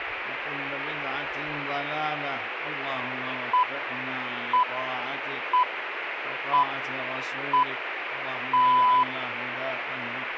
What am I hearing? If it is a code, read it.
Radio time signal (six pips, as the Greenwich Time Signal), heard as pips, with radio static.